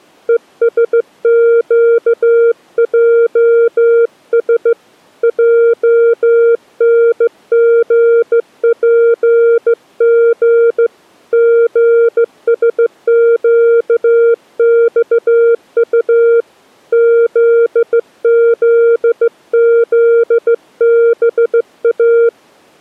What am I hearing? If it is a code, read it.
Morse code, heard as a keyed tone, hand-sent with a straight key, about 15 wpm, 460 Hz. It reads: ESQJS JNGPG GSQXU ZZZBA